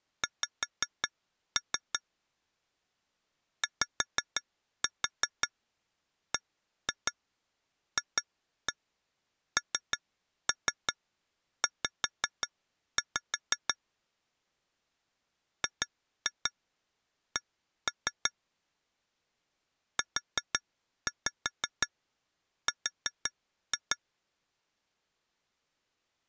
Tap code, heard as taps on glass, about 5 knocks a second. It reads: X YBFNZ GC UR